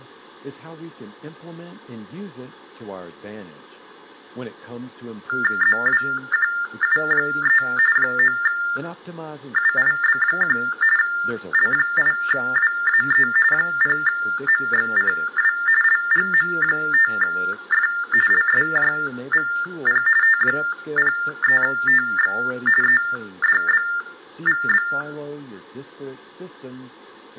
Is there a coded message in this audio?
Yes: TTY/TDD text telephone tones (45.45 baud Baudot) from 5.3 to 25.0 s, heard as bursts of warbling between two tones, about 400 Hz shift, 1600 Hz centre, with room echo and speech in English. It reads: ZWQU3 9UIB1 L8WAE 0MXCW LGM5F LSJVP T03TX EDBVB